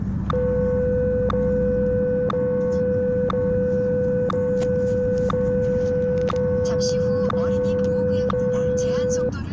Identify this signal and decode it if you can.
Radio time signal (WWVH, Hawaii), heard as ticks, one a second, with the noise inside a car.